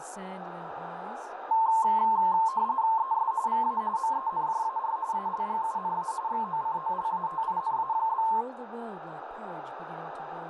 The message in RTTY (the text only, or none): ES VA MENJAR ALGUNA XOCOLATINA?